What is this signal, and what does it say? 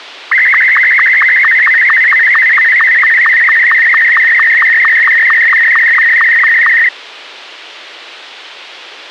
SSTV (slow-scan television), Martin M2, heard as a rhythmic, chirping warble, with a squelch burst at the end.